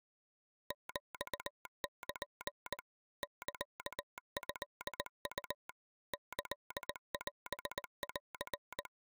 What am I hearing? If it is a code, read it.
Morse code (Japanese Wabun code), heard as a telegraph sounder, machine-sent, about 19 wpm. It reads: ヒル サトウ キオン